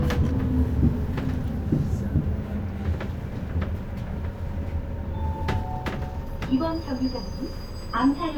The noise inside a bus. There is no code.